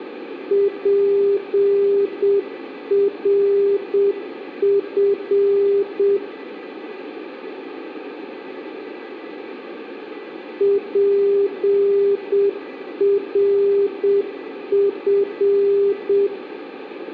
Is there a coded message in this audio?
Yes: Morse code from 0.4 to 16.3 s, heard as a keyed tone, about 7 wpm, 400 Hz, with radio static, a weaker station near 1980 Hz and room echo. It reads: PRF PRF